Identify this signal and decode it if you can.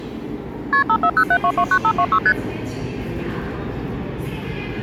Multi-frequency trunk signalling (R1, as on North American trunks), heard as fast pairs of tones, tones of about 70 ms, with the noise of a subway station. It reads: KP 5407229526 ST